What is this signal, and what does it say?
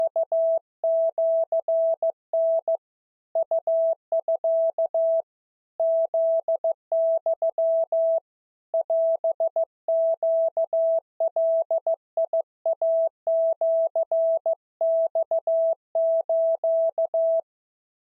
Morse code (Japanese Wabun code), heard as a keyed tone, hand-sent with a paddle, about 15 wpm, 660 Hz. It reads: … ウミ フユ オネガイシマス